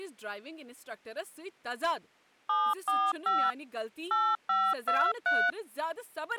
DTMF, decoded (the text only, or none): 745 8523